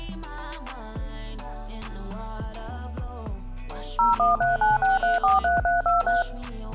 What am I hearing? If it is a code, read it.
DTMF, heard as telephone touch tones, dialled by machine, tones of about 160 ms. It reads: 01396343323